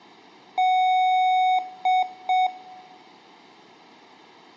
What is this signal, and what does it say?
Beep code, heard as beeps from a small speaker, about 740 Hz, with room echo. 1 long, 2 short. In Award, IBM and AMI BIOS tables: video adapter failure.